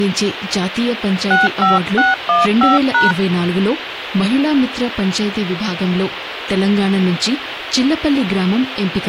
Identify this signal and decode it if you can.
DTMF, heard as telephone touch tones, dialled by hand, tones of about 170 ms, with phone line noise. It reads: 65615#